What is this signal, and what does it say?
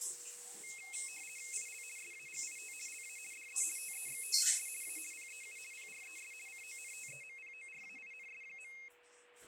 RTTY (50 baud, 450 Hz shift), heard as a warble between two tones, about 2350 Hz centre, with a steady whistle near 490 Hz and the noise of a restroom. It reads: IL SAGIT LA DE TEXTES A PEU PRES CONTEMPORAINS.